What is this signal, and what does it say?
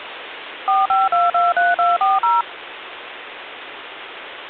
DTMF, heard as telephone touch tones, dialled by machine, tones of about 180 ms, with phone line noise. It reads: 45223240